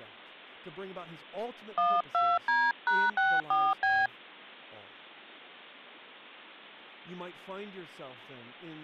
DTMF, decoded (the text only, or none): 12D#64B